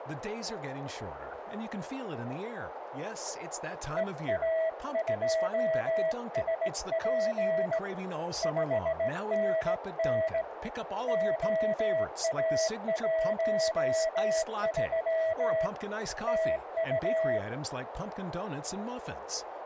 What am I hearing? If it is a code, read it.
Morse code, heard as a keyed tone, hand-sent with a straight key, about 18 wpm, 650 Hz, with radio static, a narrow filter and speech in English. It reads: EA2SP 5NN OA13 TU